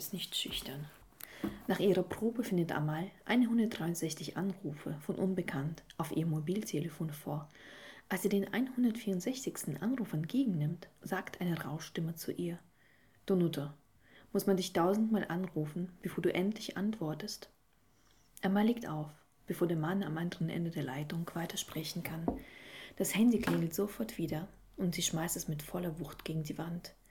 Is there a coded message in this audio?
No.